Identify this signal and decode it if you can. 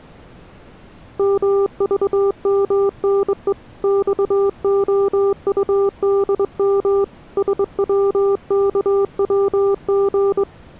Morse code, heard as a keyed tone, hand-sent with a straight key, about 23 wpm, 400 Hz. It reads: MVMNE XOUDM SWKWG